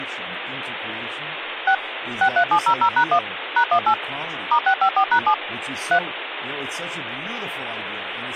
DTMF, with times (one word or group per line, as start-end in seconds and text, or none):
1.7-1.7 6
2.2-3.2 63700#1
3.6-3.9 #18
4.5-5.3 *654#7
5.9-6.0 3